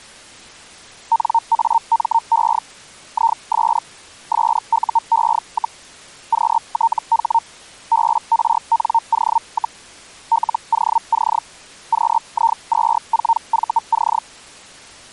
Hellschreiber (Feld-Hell, 122.5 baud), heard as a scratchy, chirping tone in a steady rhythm, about 920 Hz. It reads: NAME IS SUE, QTH BRNO, LOC QI24VC